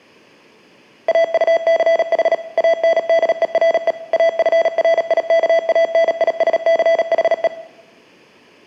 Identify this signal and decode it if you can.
Morse code, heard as electronic beeps, machine-sent, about 37 wpm, 660 Hz, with room echo. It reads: AUCH ANDERE AFRIKANISCHE